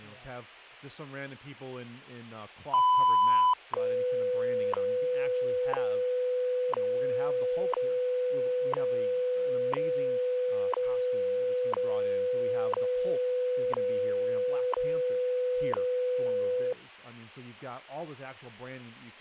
Radio time signal (WWV, Colorado), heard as ticks, one a second, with speech in English.